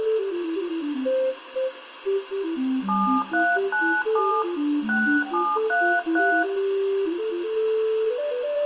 DTMF, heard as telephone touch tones, dialled by hand, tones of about 280 ms, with phone line noise and room echo. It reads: 7397 6733